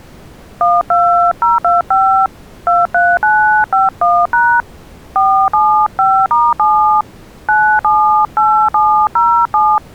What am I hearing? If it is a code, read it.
DTMF, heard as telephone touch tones, dialled by hand, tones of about 290 ms. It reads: 12025 23951# 475*7 978707